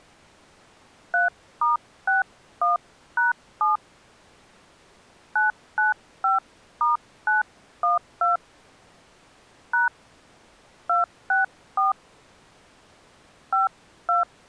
DTMF, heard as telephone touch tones, dialled by hand, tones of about 150 ms. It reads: 3*61#7 995*912 # 264 52